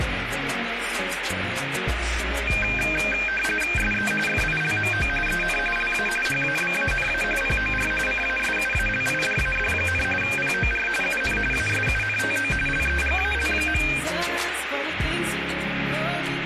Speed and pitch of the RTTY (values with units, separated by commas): 45.45 baud, 850 Hz shift, 2000 Hz centre